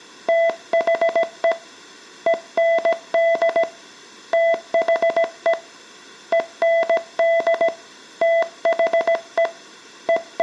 Morse code, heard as a keyed tone, hand-sent with a paddle, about 17 wpm, 670 Hz, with room echo. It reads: THE END THE END THE …